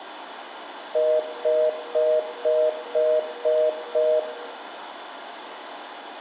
Telephone call progress tone (North American plan), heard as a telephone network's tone, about 480, 620 Hz, 0.25 s on and 0.25 s off, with phone line noise and room echo. Congestion tone.